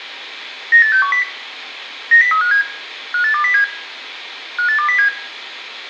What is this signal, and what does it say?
Five-tone selective call (CCIR), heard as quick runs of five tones, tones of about 100 ms, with room echo. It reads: 98610 90357 58207 58207